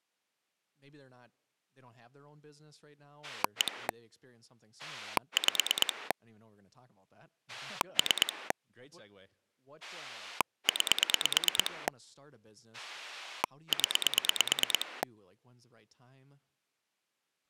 Pulse dialling, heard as a rotary dial, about 9 pulses a second, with speech in English. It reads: 1 5 3 9 0